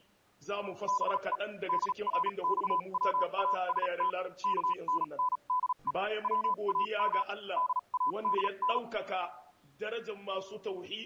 Morse code (Persian alphabet), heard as a keyed tone, machine-sent, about 37 wpm, spaced as for 31 wpm, 1000 Hz. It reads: به درخواست کننده وام دادن